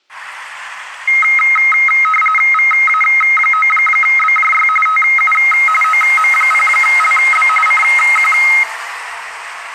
RTTY (45.45 baud, 850 Hz shift), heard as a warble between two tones, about 1700 Hz centre, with street noise. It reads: VA9BJY TU OM0LB CQ